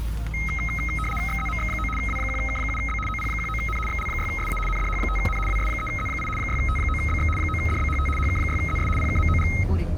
RTTY (75 baud, 850 Hz shift), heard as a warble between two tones, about 1700 Hz centre, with the noise inside a car. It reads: XZMX9 W1K7B OP19N XL6SA NDH5N WS3Z8 6T9BX 9DBHT HK6ZS PKMOG